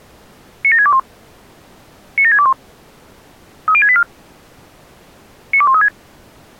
Five-tone selective call (ZVEI), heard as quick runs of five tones, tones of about 70 ms. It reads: 97621 97621 30684 92136